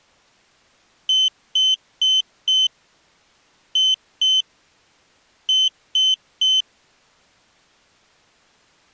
Beep code, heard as a piezo beeper, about 3050 Hz. 4-2-3. In Phoenix BIOS tables: gate A20 failure.